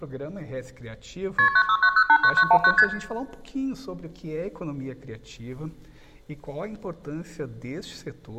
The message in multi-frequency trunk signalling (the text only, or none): KP 969089919 ST